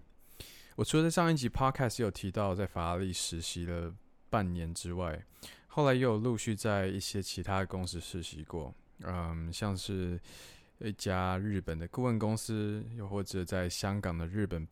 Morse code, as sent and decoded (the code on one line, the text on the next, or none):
none